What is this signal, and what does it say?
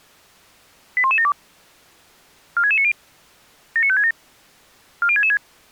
Five-tone selective call (ZVEI), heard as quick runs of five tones, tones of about 70 ms. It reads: 81172 46690 79567 40666